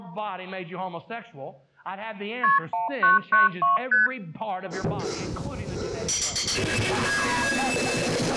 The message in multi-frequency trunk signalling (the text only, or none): KP 1992 ST